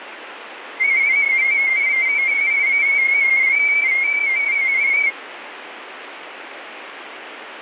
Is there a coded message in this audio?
Yes: multi-tone FSK (Olivia or MFSK type), about 250 Hz wide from 0.8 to 5.1 s, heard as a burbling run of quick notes, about 31.25 baud, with radio static.